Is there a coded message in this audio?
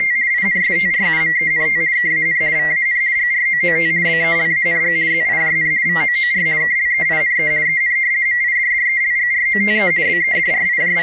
Yes: RTTY (50 baud, 170 Hz shift) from 0.0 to 11.0 s, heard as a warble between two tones, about 2000 Hz centre. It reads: … INSTRUMENT KAN VAN GROOT BELANG ZIJN VOOR KLEINE EN MIDDELGROTE …